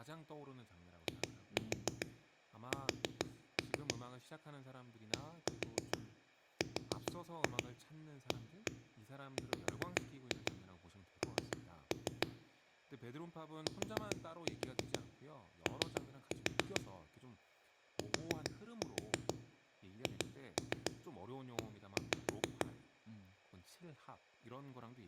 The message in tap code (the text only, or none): IS DRAWN TO THE